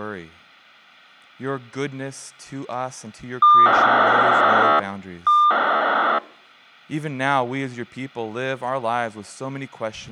POCSAG pager data (2400 baud), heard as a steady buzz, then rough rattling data, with speech in English.